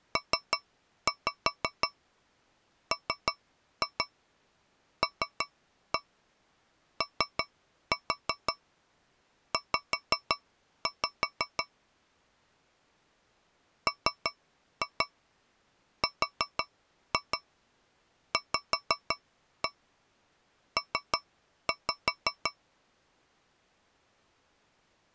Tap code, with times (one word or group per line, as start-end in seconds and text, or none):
0.2-11.6 PMLOZ
13.9-22.5 MRVP